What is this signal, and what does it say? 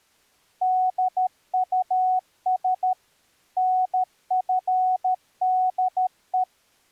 Morse code, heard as a keyed tone, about 13 wpm, 740 Hz. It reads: DUS NFDE